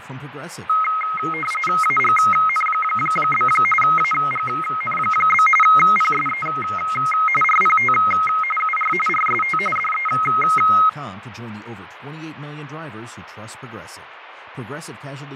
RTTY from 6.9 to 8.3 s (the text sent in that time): RPT